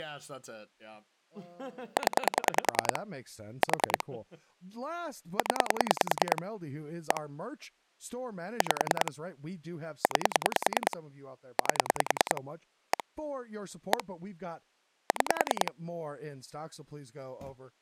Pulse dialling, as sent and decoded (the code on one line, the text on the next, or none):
10 / 4 / 10 / 1 / 5 / 9 / 8 / 1 / 1 / 6
0 4 0 1 5 9 8 1 1 6